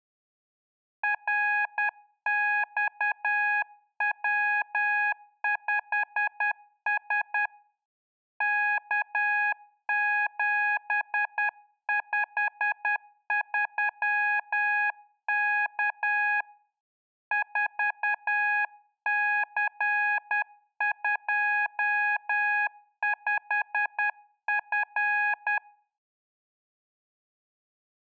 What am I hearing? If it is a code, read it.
Morse code, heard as a keyed tone, hand-sent with a paddle, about 10 wpm, 830 Hz, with room echo. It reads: RXW5S K753K 4C25F